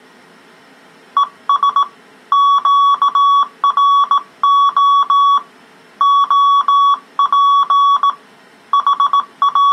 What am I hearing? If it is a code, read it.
Morse code, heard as a keyed tone, hand-sent with a bug key, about 18 wpm, 1130 Hz. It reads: ES QRO OP …